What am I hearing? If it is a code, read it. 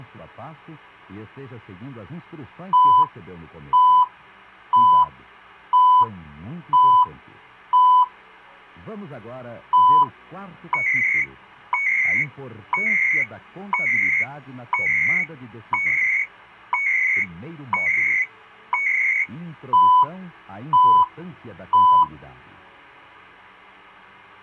Radio time signal (CHU, Canada), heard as beeps and data bursts, one a second.